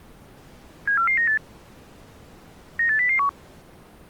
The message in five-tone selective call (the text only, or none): 74498 98001